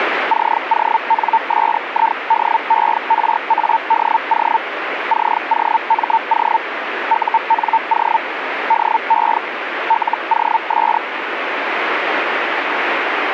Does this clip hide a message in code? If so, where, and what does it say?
Yes: Hellschreiber (Feld-Hell, 122.5 baud) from 0.3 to 11.0 s, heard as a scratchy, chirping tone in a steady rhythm, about 900 Hz, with radio static. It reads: CONSIDERADO COMO UNO DE LOS